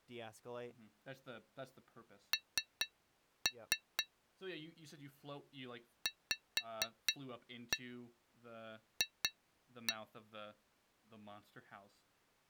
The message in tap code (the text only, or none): N VF